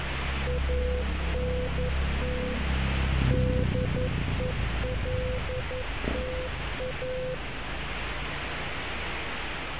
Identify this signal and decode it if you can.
Morse code, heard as a keyed tone, machine-sent, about 11 wpm, 500 Hz, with radio static and street noise. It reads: ANT DELTA